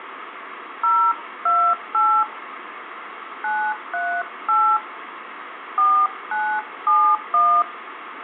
DTMF, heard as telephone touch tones, dialled by hand, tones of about 280 ms, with phone line noise and room echo. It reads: 028 938 4971